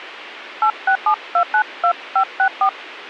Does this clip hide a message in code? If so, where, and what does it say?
Yes: DTMF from 0.6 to 2.7 s, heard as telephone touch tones, dialled by hand, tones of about 80 ms. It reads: 867292564